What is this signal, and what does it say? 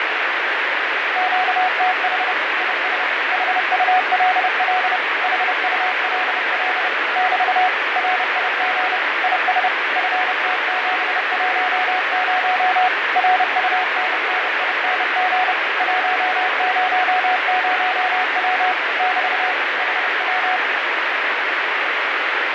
Morse code, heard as a keyed tone, machine-sent, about 30 wpm, 740 Hz, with heavy radio static and fading. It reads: QTH IS HULL HULL <BT> RIG IS FT710 RUNNING 100W <BT> HW